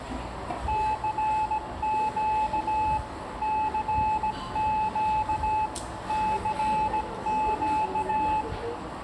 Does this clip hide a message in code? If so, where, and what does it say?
Yes: Morse code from 0.6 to 8.5 s, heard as a keyed tone, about 17 wpm, 860 Hz, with radio static, room echo and the noise of a crowd indoors. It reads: CQ CQ CQ